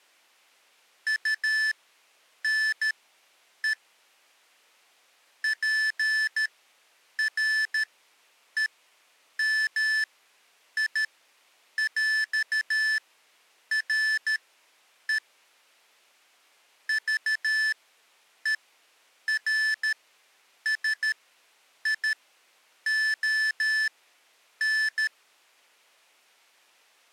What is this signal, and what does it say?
Morse code (with French letters), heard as electronic beeps, machine-sent, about 13 wpm, spaced as for 8 wpm, 1750 Hz. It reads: UNE PREMIÈRE VERSION